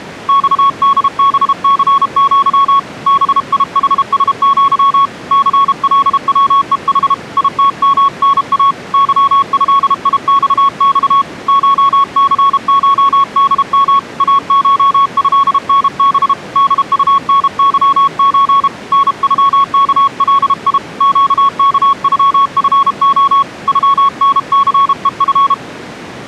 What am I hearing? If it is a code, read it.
Morse code (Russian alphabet), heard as a keyed tone, hand-sent with a paddle, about 32 wpm, 1110 Hz. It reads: ЬДБЦЪ БИХСЪ ЦЛВЕХ ИТМНА ЫЭИЬЬ ШЦШДМ АШЭНБ ДУНЫЧ НЮКЛИ ЩКЮФО ЮНЦЕФ